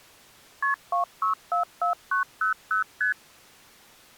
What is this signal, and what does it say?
Multi-frequency trunk signalling (R1, as on North American trunks), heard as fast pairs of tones, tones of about 120 ms. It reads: KP 2644900 ST